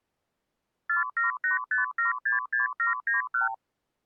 Multi-frequency trunk signalling (R2, with the far end's replies), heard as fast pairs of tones, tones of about 140 ms. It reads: 4785766791